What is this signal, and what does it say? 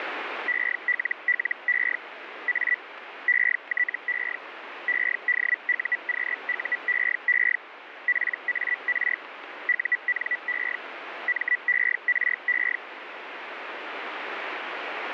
Hellschreiber (Feld-Hell, 122.5 baud), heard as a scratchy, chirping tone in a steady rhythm, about 1950 Hz, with radio static. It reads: ELLE A ETE EDUQUEE PAR UNE MERE